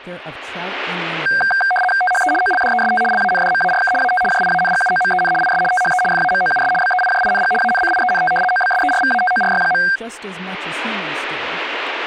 RTTY (75 baud, 850 Hz shift), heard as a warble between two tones, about 1160 Hz centre. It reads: THE OLDEST LANDMARK AT JIANGUOMEN IS THE FAMOUS BEIJING ANCIENT OBSERVATORY.